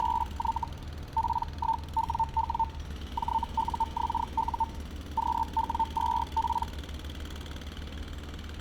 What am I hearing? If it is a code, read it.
Hellschreiber (Feld-Hell, 122.5 baud), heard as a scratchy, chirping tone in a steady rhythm, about 900 Hz, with street noise. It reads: … P1WW JUXU QW2P